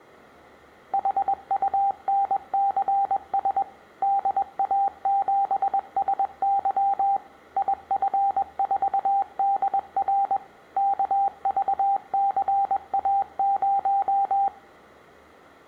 Morse code, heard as a keyed tone, machine-sent, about 21 wpm, 790 Hz, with room echo. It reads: HUNCS DA7SY IF4DR KVCA0